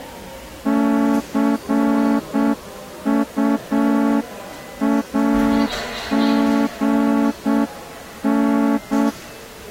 Morse code, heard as a horn, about 7 wpm, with the noise of a subway station. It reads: CUAGN